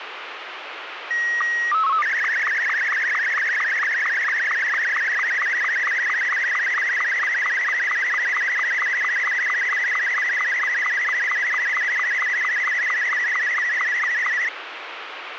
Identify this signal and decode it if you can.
SSTV (slow-scan television), Martin M2, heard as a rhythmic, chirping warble, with radio hiss.